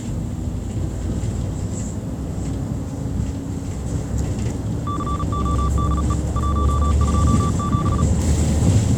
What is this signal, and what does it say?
Morse code, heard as a keyed tone, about 37 wpm, 1160 Hz, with the noise inside a bus. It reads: CODE 127